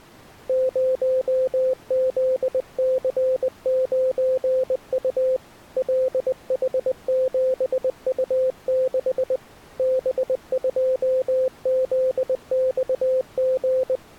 Morse code, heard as a keyed tone, hand-sent with a paddle, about 20 wpm, 520 Hz. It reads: 0ZC9U LH7U6 B2ZXG